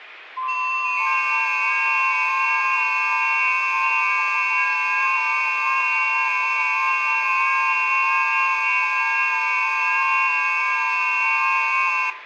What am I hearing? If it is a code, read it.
FT8 (several signals at once), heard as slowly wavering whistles, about 6.25 baud, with radio static and room echo.